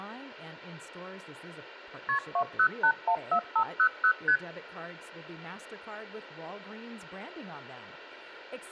Multi-frequency trunk signalling (R1, as on North American trunks), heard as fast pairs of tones, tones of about 80 ms, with speech in English. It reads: KP 20814500 ST